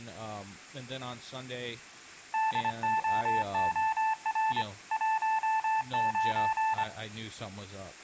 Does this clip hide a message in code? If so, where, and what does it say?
Yes: Morse code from 2.3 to 6.9 s, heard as a keyed tone, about 25 wpm, 880 Hz, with speech in English. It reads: DOOR 19